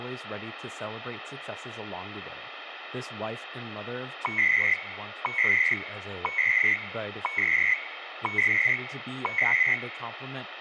Radio time signal (CHU, Canada), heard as beeps and data bursts, one a second, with radio static and speech in English.